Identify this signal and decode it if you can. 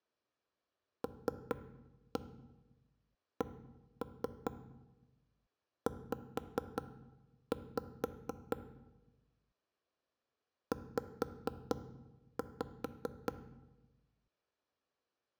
Tap code, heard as knocks on wood, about 4 knocks a second, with room echo. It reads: LCZ Z